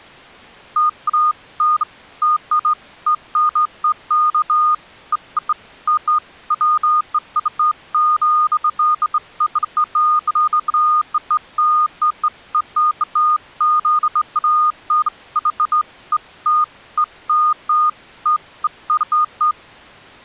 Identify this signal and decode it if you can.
Beeps of irregular length. There is no code.